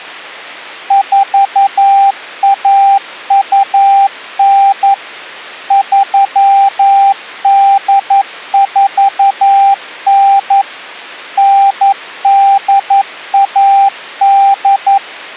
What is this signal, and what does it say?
Morse code (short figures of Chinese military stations), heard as a keyed tone, machine-sent, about 11 wpm, 790 Hz. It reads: 4129 3849 9818